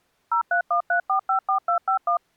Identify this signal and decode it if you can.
DTMF, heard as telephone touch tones, dialled by machine, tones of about 100 ms. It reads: 0313454251